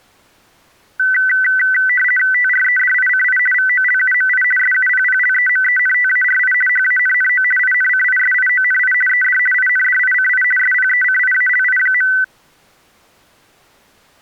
RTTY (50 baud, 450 Hz shift), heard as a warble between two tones, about 1750 Hz centre. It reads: TREDICI VOLUMI SUPPLEMENTARI HANNO INCISIONI ED INDICI SPECIALI.